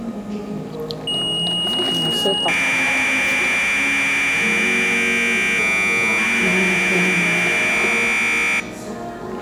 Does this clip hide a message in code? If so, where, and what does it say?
Yes: Commodore tape loading (standard loader) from 1.1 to 8.6 s, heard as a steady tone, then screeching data, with room echo and the noise of a cafe.